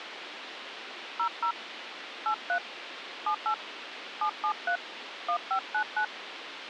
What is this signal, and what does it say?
DTMF, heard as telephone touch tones, dialled by hand, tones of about 80 ms, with radio hiss. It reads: 00 83 78 773 1599